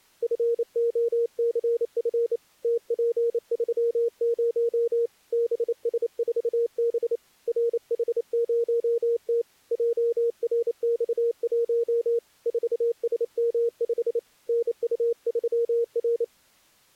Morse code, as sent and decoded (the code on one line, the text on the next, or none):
..-. --- -.-. ..-. / - .--. ...-- ----- / -... ... ....- -... / .-. .... ----- - / .--- .-. -..- .---- / ....- ... -- ..... / -. ..- ...-- .-.
FOCF TP30 BS4B RH0T JRX1 4SM5 NU3R